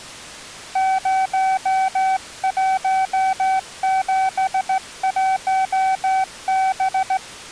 Morse code, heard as a keyed tone, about 16 wpm, 760 Hz. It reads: 0171B